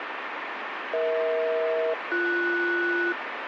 Aircraft SELCAL, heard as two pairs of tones, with radio static. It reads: EH-BS